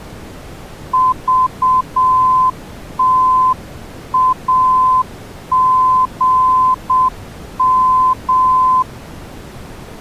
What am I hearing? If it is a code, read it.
Morse code, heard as a keyed tone, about 7 wpm, 1020 Hz. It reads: VTAGM